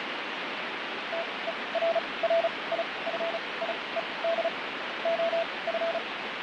Morse code, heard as a keyed tone, machine-sent, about 35 wpm, spaced as for 23 wpm, 670 Hz, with heavy radio static and fading. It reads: TERRIFIED OF